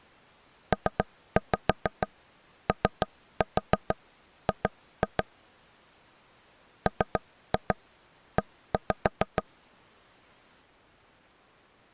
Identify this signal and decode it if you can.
Tap code, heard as taps on a table, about 6 knocks a second. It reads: POG ME